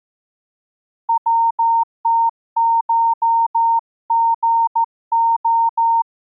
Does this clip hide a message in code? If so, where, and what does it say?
Yes: Morse code (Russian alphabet) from 1.0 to 6.1 s, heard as a keyed tone, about 14 wpm, 920 Hz. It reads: ВТШГО